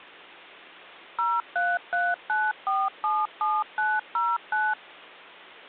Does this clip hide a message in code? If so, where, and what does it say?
Yes: DTMF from 1.2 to 4.7 s, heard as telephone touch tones, dialled by machine, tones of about 220 ms. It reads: 0339477909